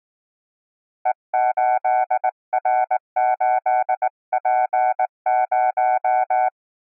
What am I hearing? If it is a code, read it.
Morse code, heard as a keyed tone, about 19 wpm, 750 Hz. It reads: E8R8P0